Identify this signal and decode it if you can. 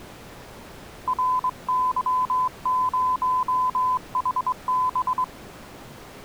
Morse code, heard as a keyed tone, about 23 wpm, 1010 Hz. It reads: RY0HB